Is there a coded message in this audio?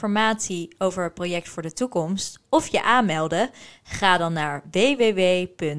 No, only speech in Dutch.